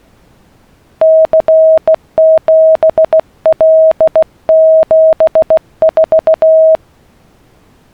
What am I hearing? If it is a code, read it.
Morse code, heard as a keyed tone, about 16 wpm, 640 Hz. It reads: C7L74